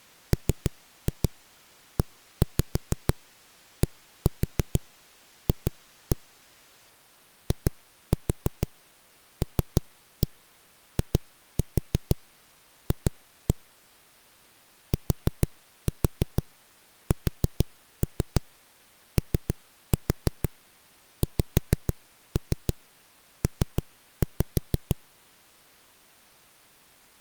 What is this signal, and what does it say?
Tap code, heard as knocks on a wall, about 6 knocks a second. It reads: MEDF ILIF TSOXP